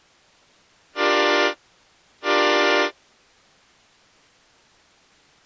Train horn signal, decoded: 2 short

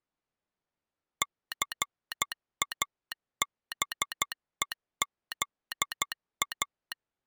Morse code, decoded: CABEZA

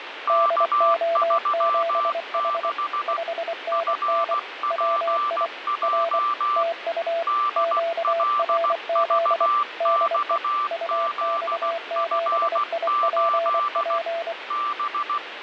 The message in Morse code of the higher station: K36 FPJ DLVXZF8 B

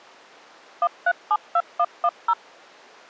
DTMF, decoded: 1372110

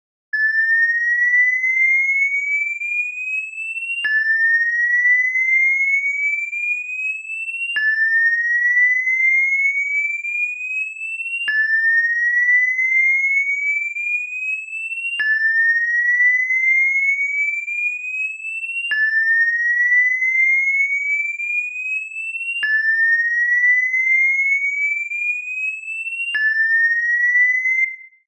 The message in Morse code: none

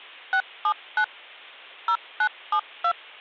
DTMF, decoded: 679 0972

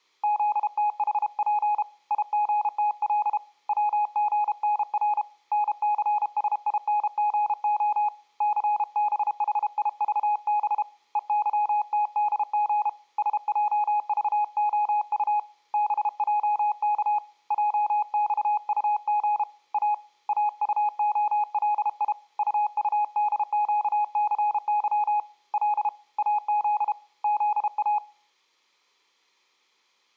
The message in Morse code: ZTHP IGTL WGNR NCSINGO CBHIVB EYTDG SJVOU BJK JXUG A AUOLI UUDQCY L AZ ZA

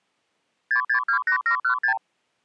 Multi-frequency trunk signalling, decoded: 6628716

